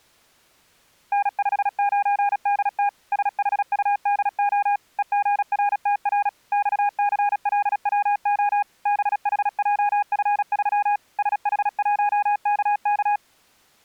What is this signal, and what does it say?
Morse code, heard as a keyed tone, machine-sent, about 36 wpm, 820 Hz. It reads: N59DT SHUDO EGRTR XCLWO BHJF3 SH1KK